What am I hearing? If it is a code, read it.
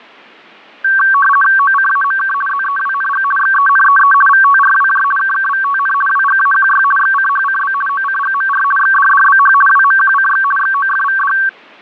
RTTY (50 baud, 450 Hz shift), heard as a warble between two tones, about 1340 Hz centre, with fading. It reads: OCAMK ZEWNG XENEE VTRWJ KKVTN WGAQY XCHCB OCGMR XDDBH WMQCX XOFVD